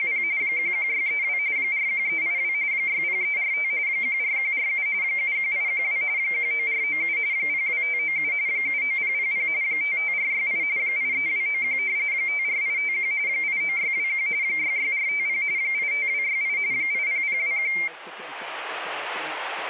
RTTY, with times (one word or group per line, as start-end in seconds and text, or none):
0.0-0.2 …
0.4-1.4 11632
1.6-2.5 41382
2.7-3.7 60345
3.9-4.9 14147
5.0-6.0 71812
6.2-7.2 19497
7.3-8.3 02597
8.5-9.5 79000
9.6-10.6 55468
10.8-11.8 83291
12.1-13.1 54851
13.3-14.3 89621
14.4-15.4 66450
15.6-16.6 85268
16.7-17.7 80021